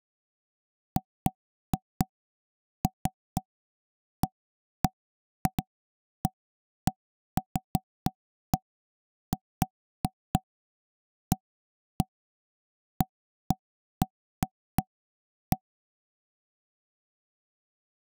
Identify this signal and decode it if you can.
Irregular knocks on wood. There is no code.